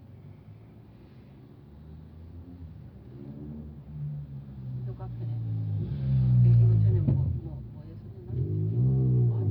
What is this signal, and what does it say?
The noise inside a car. There is no code.